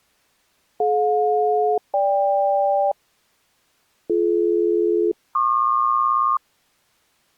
Aircraft SELCAL, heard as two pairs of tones. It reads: DJ-GK BD-PQ